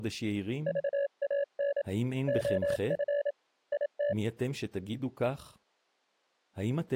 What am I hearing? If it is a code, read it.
Morse code, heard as a keyed tone, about 27 wpm, 570 Hz, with speech in Hebrew. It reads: VAN OF IT